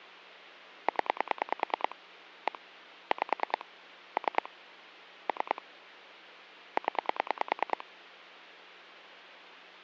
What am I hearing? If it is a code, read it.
Pulse dialling, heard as clicks on a phone line, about 9 pulses a second. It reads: 0 1 5 3 3 0